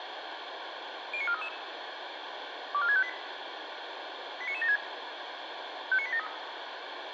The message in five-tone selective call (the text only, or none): 09433 24658 89976 59873